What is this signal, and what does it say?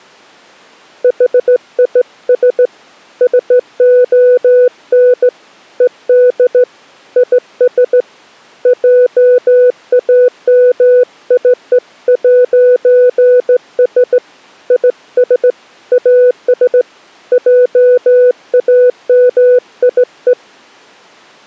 Morse code, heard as a keyed tone, hand-sent with a straight key, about 16 wpm, 500 Hz. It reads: HIS SON ED IS JAMIE'S IS AS JAMIE